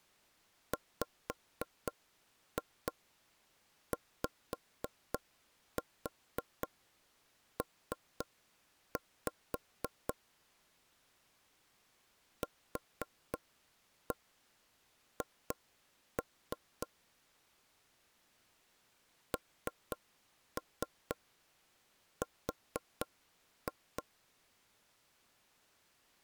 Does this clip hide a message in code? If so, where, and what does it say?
Yes: tap code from 0.7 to 24.0 s, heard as knocks on wood, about 3 knocks a second. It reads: WYP QH NR